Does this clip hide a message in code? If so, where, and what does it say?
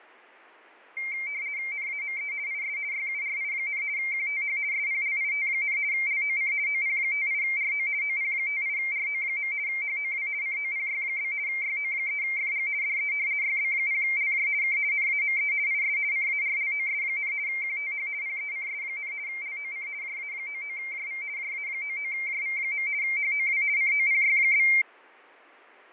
Yes: RTTY (50 baud, 170 Hz shift) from 1.0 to 24.8 s, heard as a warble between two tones, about 2200 Hz centre, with fading. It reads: NAME IS YURI, QTH SPLIT, LOC OP58RO OP58RO. HOW COPY? YO3FG DE YB0LJ K NAME IS CARLOS, QTH PECS, LOC JA99JV JA99JV. HOW COPY?